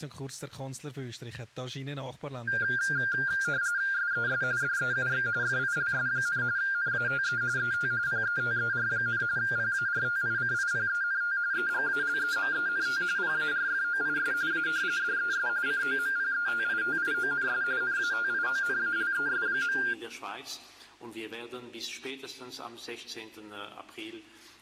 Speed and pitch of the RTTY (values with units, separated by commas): 45.45 baud, 170 Hz shift, 1500 Hz centre